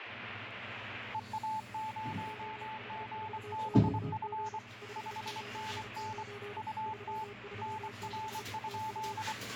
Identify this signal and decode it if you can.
Morse code, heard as two keyed tones, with radio static and the noise of a restroom. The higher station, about 24 wpm, 870 Hz: EA0GBF 5NN UT NR?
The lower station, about 33 wpm, 410 Hz: OH4QG 599 336 TU